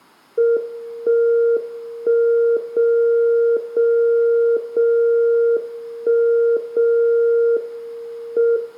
Radio time signal (WWVB), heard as a tone whose level steps once a second, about 470 Hz, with room echo. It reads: 1 1 0 0 0 1 0 M